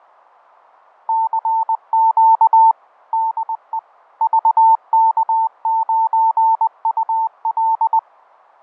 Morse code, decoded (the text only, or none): CQ DE VK9UL